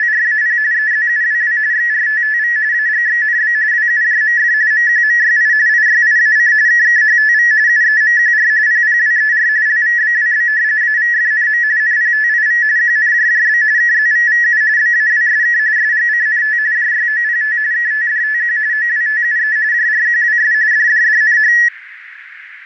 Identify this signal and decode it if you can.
RTTY (45.45 baud, 170 Hz shift), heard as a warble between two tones, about 1800 Hz centre, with radio static. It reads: … EZUWW XRTTV AGXNB WUJMF MQMYI IYIAC KKHTV UEMQR PPWER LVBWB AVFNM NPTIV QNJJB KZVVU BAWSK SGCNT JYOPT KTDTQ OWTUE JRQWS DDDNH